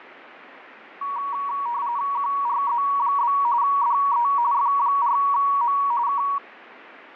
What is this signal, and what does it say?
RTTY (45.45 baud, 170 Hz shift), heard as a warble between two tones, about 1040 Hz centre, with radio static. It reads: QRZ? DE F4M K